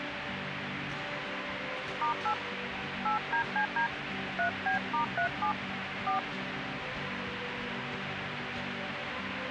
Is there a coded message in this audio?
Yes: DTMF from 2.0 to 6.2 s, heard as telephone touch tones, dialled by hand, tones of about 100 ms, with radio hiss. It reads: *8 8DCD 3B*37 4